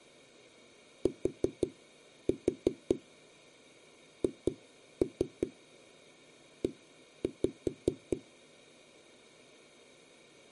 Tap code, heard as knocks on a wall, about 5 knocks a second. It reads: THE